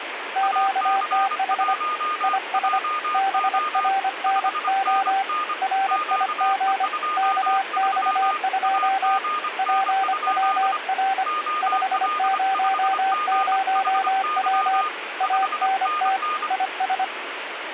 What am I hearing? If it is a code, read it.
Morse code, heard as two keyed tones, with radio static. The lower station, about 25 wpm, 770 Hz: QTH IS BRNO RIG KX2 PWR 500W ANT IS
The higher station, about 25 wpm, 1220 Hz: AC1JO 5NN QE23 AGN? OL5GHY 5NN